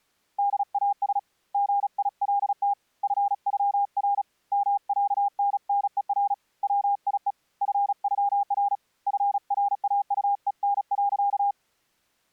Morse code (with German letters), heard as a keyed tone, hand-sent with a paddle, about 36 wpm, 810 Hz. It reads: DAS GILT FÜR MÄNNER WIE FÜR FRAUEN.